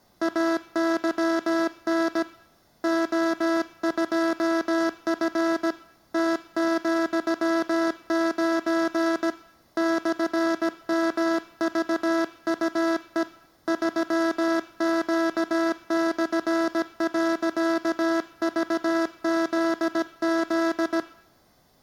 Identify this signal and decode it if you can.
Morse code, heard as a buzzer, hand-sent with a paddle, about 17 wpm. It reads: AYN O2F T,9 /MVUE 3Q/.VZZ